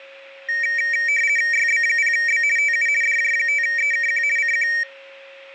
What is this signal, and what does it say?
RTTY (50 baud, 450 Hz shift), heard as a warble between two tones, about 2100 Hz centre, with a steady whistle near 550 Hz. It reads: YB0B TU DJ5EKQ CQ